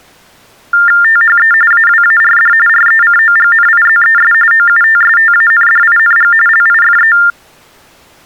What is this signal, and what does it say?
TTY/TDD text telephone tones (45.45 baud Baudot), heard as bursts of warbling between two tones, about 400 Hz shift, 1600 Hz centre. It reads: THE AWARD RECOGNIZES OUTSTANDING LIFE